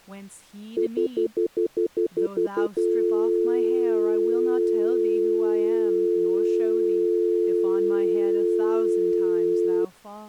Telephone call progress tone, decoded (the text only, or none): stutter dial tone